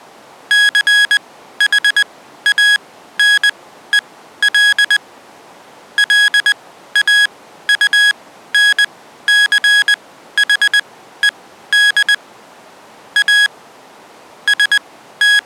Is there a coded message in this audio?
Yes: Morse code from 0.4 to 15.5 s, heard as electronic beeps, machine-sent, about 20 wpm, spaced as for 13 wpm, 1650 Hz. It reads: CHANEL LAUNCHED A …